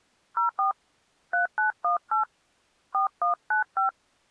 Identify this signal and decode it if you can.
DTMF, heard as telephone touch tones, dialled by hand, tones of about 120 ms. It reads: 04 3918 4195